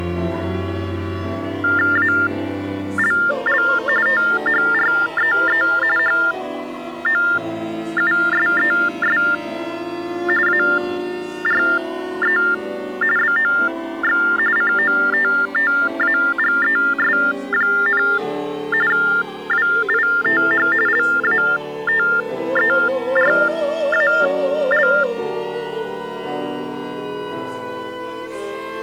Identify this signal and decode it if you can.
TTY/TDD text telephone tones (45.45 baud Baudot), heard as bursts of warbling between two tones, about 400 Hz shift, 1600 Hz centre. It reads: ALL THREE HOUSES ARE BOX COTTAGES, WITH LATERAL